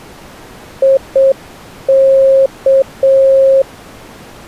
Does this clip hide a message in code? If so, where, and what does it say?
Yes: Morse code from 0.8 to 3.7 s, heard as a keyed tone, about 7 wpm, 540 Hz. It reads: IK